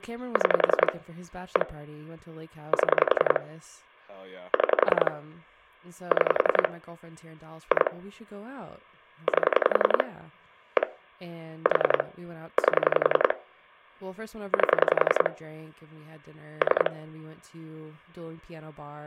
Pulse dialling, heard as clicks on a phone line, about 11 pulses a second, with speech in English. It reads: 6 1 7 6 6 2 8 1 4 8 8 3